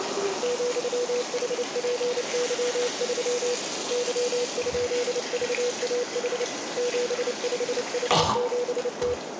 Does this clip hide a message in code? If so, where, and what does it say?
Yes: Morse code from 0.4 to 9.2 s, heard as a keyed tone, hand-sent with a paddle, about 29 wpm, 490 Hz, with radio static, a narrow filter and the noise of a restroom. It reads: ,HPY3 Y?VAH 75H7T